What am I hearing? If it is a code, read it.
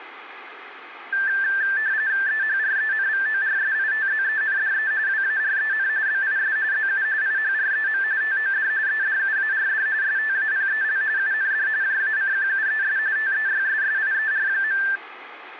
RTTY (45.45 baud, 170 Hz shift), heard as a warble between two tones, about 1650 Hz centre, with radio static. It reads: EHRENVORSITZENDE WAREN BIS ZU IHREM TOD EDUARD STAPEL UND JACQUES TEYSSIER.